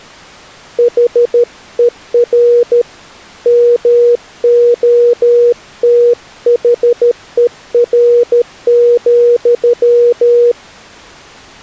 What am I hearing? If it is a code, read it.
Morse code, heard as a keyed tone, hand-sent with a paddle, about 13 wpm, 480 Hz. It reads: HER MOTHER,